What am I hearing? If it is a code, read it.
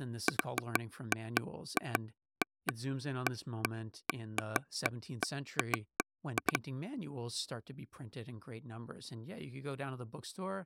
Irregular taps on a table, with speech in English. There is no code.